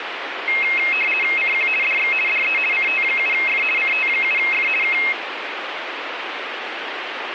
RTTY (50 baud, 450 Hz shift), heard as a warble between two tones, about 2350 Hz centre, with radio static. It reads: CQ DX DE CT7F CT7F K